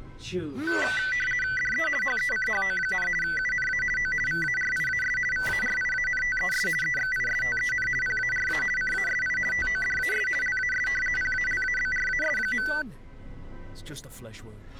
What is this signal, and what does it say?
RTTY (50 baud, 450 Hz shift), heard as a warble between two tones, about 1750 Hz centre. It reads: DE HECHO, UNA O VARIAS VARIANTES EXISTEN PARA CASI TODAS LAS PALABRAS.